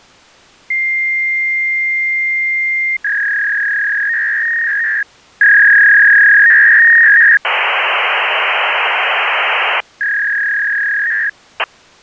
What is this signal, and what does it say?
Fax machine handshake, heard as a long tone, a warble and hiss.